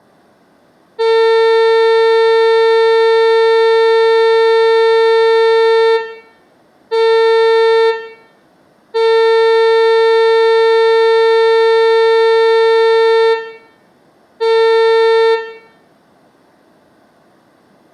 Ship horn signal, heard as a ship's horn, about 450 Hz, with room echo. 1 long, 1 short, 1 long, 1 short. At sea: I agree to be overtaken.